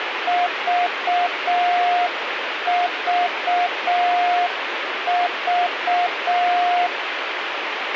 Morse code, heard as a keyed tone, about 6 wpm, 710 Hz, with radio hiss and a squelch burst at the end. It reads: VVV